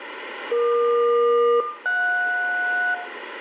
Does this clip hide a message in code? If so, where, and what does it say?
Yes: aircraft SELCAL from 0.5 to 2.9 s, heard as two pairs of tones, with radio static and room echo. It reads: EQ-JS